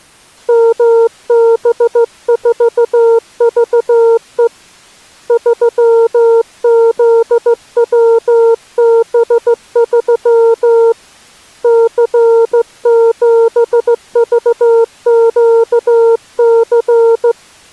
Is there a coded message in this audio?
Yes: Morse code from 0.4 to 17.4 s, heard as a keyed tone, hand-sent with a straight key, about 15 wpm, 460 Hz. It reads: MB4VE 3ZWB3 C7VQC